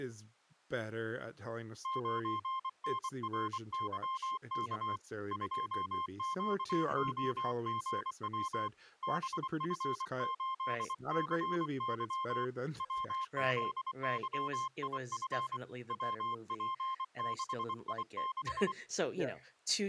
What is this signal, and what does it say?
Morse code, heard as a keyed tone, hand-sent with a paddle, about 24 wpm, 1060 Hz, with speech in English. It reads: 9NRYK 2QOGW BF8CY WZYIF WP6I6